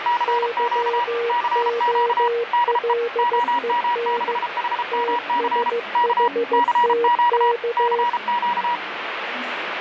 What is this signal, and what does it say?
Morse code, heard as two keyed tones, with radio static and the noise of a subway station. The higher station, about 33 wpm, 960 Hz: CQ CQ DE OM6HMC K CQ CQ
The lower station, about 15 wpm, 470 Hz: YOLEN TSHTK